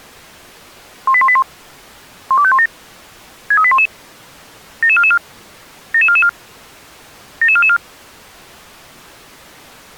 Five-tone selective call (ZVEI), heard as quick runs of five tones, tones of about 70 ms. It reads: 18181 12517 63811 77444 77444 77444